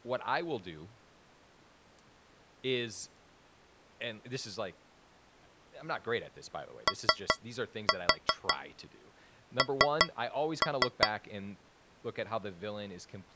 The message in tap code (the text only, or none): ON